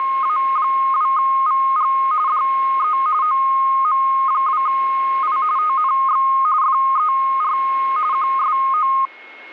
RTTY (45.45 baud, 170 Hz shift), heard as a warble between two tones, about 1160 Hz centre, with a steady whistle near 2170 Hz. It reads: … DE OM2I TNX FER QSO